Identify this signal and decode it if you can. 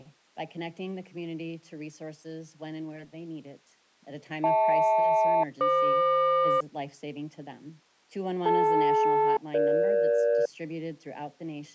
Aircraft SELCAL, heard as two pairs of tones. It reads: HL-FQ DL-EG